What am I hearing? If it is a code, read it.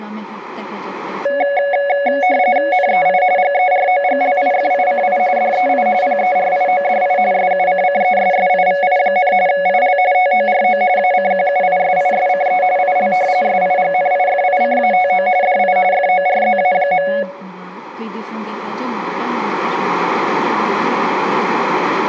RTTY (45.45 baud, 170 Hz shift), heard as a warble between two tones, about 650 Hz centre, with speech in Arabic. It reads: NEI GEROGLIFICI DEI PERIODI SUCCESSIVI, IL TORO ACQUISISCE IL SIGNIFICATO DI FORZA.